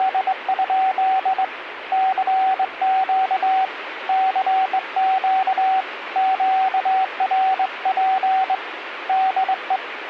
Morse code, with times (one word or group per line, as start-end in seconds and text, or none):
0.0-1.4 …
1.9-3.6 CQ
4.1-5.8 CQ
6.2-8.5 QRP
9.1-9.8 DE